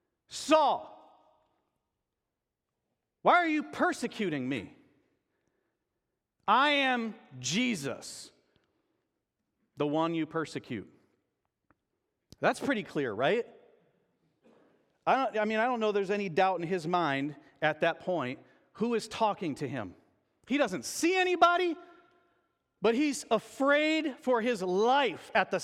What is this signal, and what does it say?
Speech in English. There is no code.